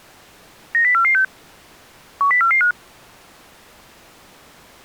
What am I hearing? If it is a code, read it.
Five-tone selective call (CCIR), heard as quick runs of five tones, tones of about 100 ms. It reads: 90446 10445